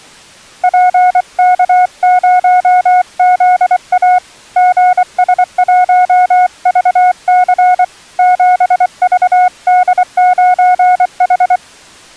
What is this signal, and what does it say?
Morse code, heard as a keyed tone, hand-sent with a paddle, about 24 wpm, 730 Hz. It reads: PK0ZA GS1VC 7VD9H